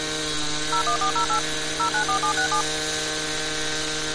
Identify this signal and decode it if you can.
DTMF, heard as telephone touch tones, dialled by machine, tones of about 100 ms, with street noise. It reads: 01408 094767